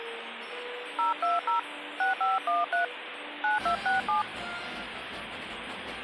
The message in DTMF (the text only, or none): 020 6513 9267